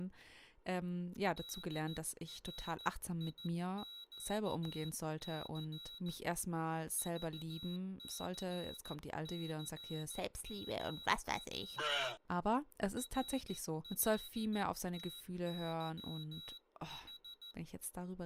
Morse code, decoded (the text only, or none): DRIQC VCCMW RLTYH